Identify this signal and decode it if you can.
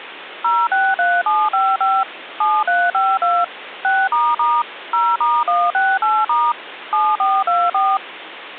DTMF, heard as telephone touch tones, dialled by machine, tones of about 230 ms, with phone line noise. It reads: 063755 7352 6** 0*168* 7424